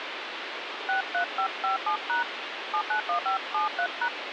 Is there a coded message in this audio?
Yes: DTMF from 0.9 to 4.1 s, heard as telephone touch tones, dialled by hand, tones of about 90 ms, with phone line noise. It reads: 63557# 791573#